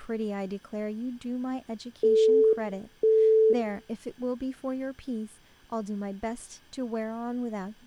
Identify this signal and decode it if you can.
Telephone call progress tone (single-tone plan, as in Europe, Japan and elsewhere), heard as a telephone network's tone, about 440 Hz, 0.5 s on and 0.5 s off, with room echo and speech in English. Busy tone.